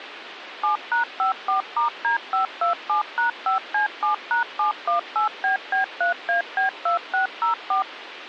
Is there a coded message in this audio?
Yes: DTMF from 0.6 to 7.8 s, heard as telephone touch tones, dialled by machine, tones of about 120 ms, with phone line noise. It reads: 7#54*D527#5C7#718BB3AB2604